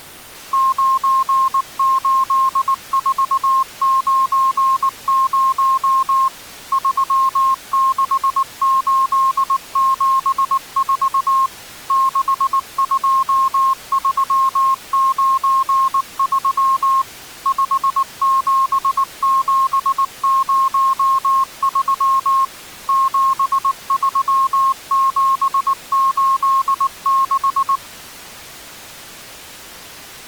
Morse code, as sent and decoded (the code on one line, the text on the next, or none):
----. ---.. ....- ----. ----- / ...-- -.... ---.. --... ....- / -.... ..--- ...-- ----. ...-- / ..... --... --... ----- ...-- / --... ...-- --... ---.. -....
98490 36874 62393 57703 73786